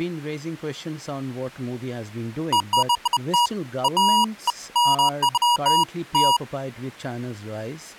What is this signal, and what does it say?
Beeps of irregular length, with speech in English. There is no code.